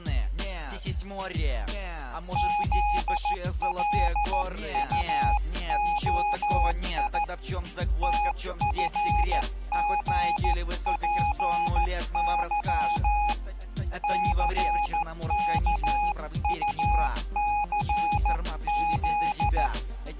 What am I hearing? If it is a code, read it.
Morse code, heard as a keyed tone, hand-sent with a paddle, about 14 wpm, 830 Hz. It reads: ZLUOI TFGPY CKUCZ